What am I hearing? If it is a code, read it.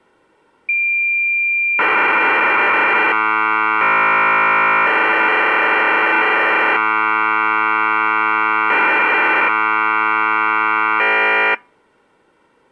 Cassette data (Kansas City type), 1200 baud, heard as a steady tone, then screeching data.